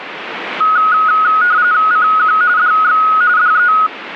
RTTY (45.45 baud, 170 Hz shift), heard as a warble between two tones, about 1360 Hz centre, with radio static. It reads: CQ DX DE